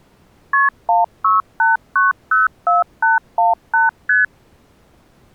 Multi-frequency trunk signalling (R1, as on North American trunks), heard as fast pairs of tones, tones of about 160 ms. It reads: KP 168904818 ST